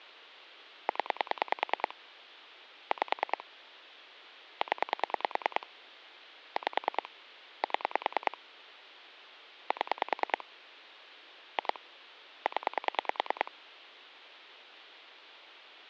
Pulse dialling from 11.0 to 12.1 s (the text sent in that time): 2